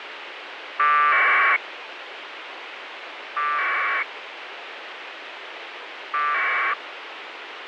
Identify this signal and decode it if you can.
Packet radio (AX.25, as in APRS), 1200 baud, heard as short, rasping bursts, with radio hiss.